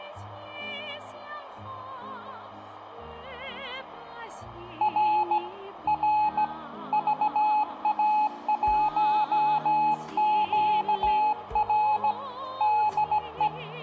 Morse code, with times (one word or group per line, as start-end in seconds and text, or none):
4.8-5.4 R
5.9-6.4 R
6.9-12.1 VA1QR
12.6-13.5 DE